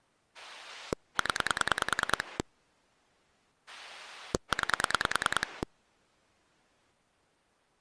Pulse dialling, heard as a rotary dial, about 10 pulses a second. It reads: 0 9